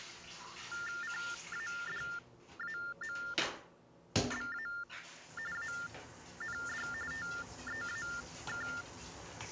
TTY/TDD text telephone tones (45.45 baud Baudot), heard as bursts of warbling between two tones, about 400 Hz shift, 1600 Hz centre, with the noise of a restroom. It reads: CADAMBA AND TEAK